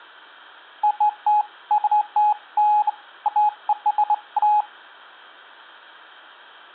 Beeps of irregular length. There is no code.